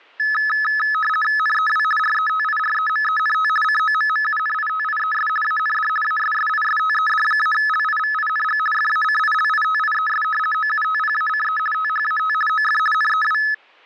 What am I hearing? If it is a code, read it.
RTTY (50 baud, 450 Hz shift), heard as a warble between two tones, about 1500 Hz centre. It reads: NEW RETIREMENT COMMUNITIES AND ASSISTED-LIVING FACILITIES OUTPACE THAT OF NEW